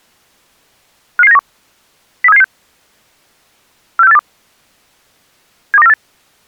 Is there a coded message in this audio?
Yes: five-tone selective call (EEA) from 1.2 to 5.9 s, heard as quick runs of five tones, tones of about 40 ms. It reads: 55791 03776 46482 72948